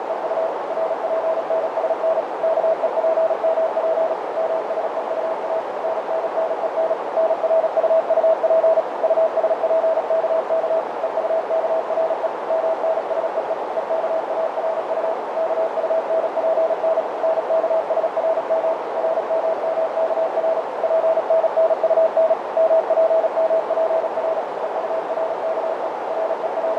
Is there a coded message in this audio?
Yes: Morse code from 0.0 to 26.8 s, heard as a keyed tone, machine-sent, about 36 wpm, 650 Hz, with heavy radio static, fading and a narrow filter. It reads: … RPNSN KEPMP MSEUA NNNEN NRUUP USPKK EUKRE MNSEE EKARU KUNPN NKSRM RMMKR PNNUN MPMPR EURKE …